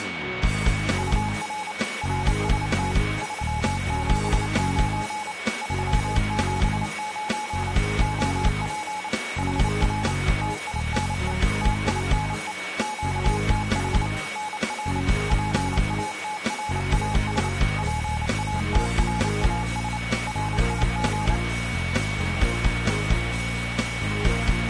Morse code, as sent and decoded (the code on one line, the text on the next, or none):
..- .-. / .-. ... - / ...-- --... ----. / ...-- --... ----. / --- .--. / .... .-. / - .. -. . / - .. -. . / --.- - .... / -. .-. / .--. .- - .-. .- ... / .--. .- - .-. .- ... / .-. .. --.
UR RST 379 379 OP HR TINE TINE QTH NR PATRAS PATRAS RIG